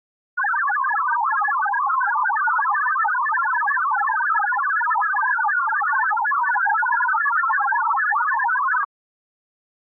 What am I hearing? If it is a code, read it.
Multi-tone FSK (Olivia or MFSK type), about 1000 Hz wide, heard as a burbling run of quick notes, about 62.5 baud.